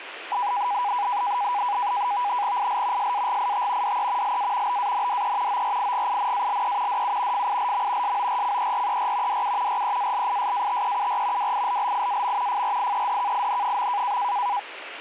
NAVTEX (SITOR-B), 100 baud, 170 Hz shift, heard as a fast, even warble, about 900 Hz centre, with radio static. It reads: IL SAGIT DE LA BANDE ORIGINALE DU FILM SORCERER DU REALISATEUR WILLIAM FRIEDKIN.